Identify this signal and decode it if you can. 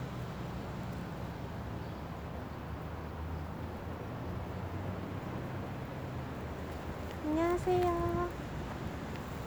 The noise of a residential street. There is no code.